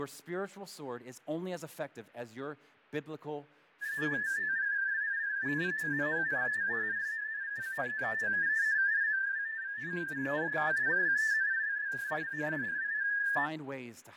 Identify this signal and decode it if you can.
Multi-tone FSK (Olivia or MFSK type), about 250 Hz wide, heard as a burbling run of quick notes, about 31.25 baud, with fading and speech in English.